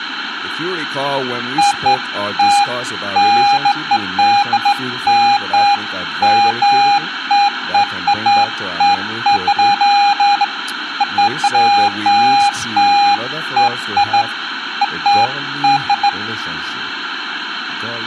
Beeps of irregular length, with phone line noise, room echo and speech in English. There is no code.